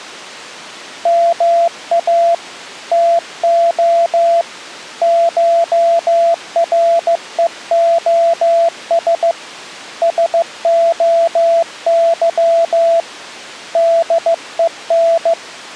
Morse code (Greek alphabet), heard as a keyed tone, hand-sent with a paddle, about 15 wpm, 670 Hz. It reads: ΜΑ ΤΟ ΧΡΕΟΣ ΣΟΥ ΔΕΝ